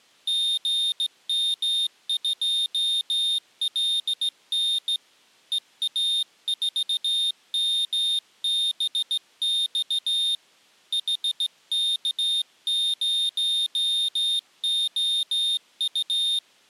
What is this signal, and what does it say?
Morse code, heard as a high beeper, hand-sent with a straight key, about 16 wpm, 3650 Hz. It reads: GM2LN EA4MBX HK0OU